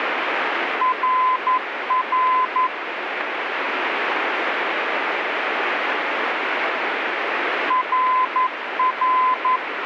Morse code, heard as a keyed tone, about 11 wpm, 1020 Hz, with radio static. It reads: RR RR